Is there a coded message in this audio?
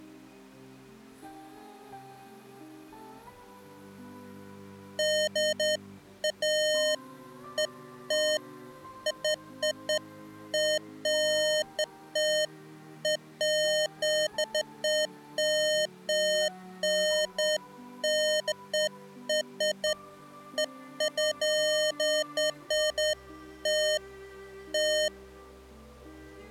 No, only beeps of irregular length.